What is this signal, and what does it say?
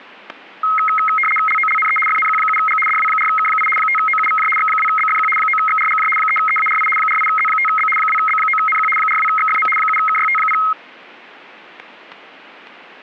RTTY (75 baud, 850 Hz shift), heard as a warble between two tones, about 1700 Hz centre, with static crashes. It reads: LOLNE FNQ7G DW4K8 5OUVJ X2BFQ 9XRGJ 3EARI 48Z5B 2B9NQ 42XFM 7KYT0